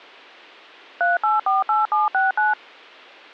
DTMF, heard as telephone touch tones, dialled by machine, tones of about 160 ms. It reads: 3848769